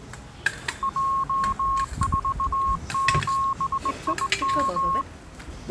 Morse code, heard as a keyed tone, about 19 wpm, 1080 Hz, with the noise of a restaurant. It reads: J47IM